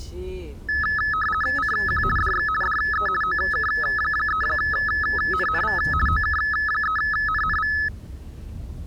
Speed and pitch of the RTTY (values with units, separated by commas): 50 baud, 450 Hz shift, 1500 Hz centre